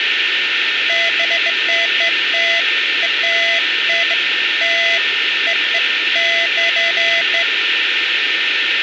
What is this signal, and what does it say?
Beeps of irregular length, with radio static, a steady whistle near 1800 Hz and speech in Nepali. There is no code.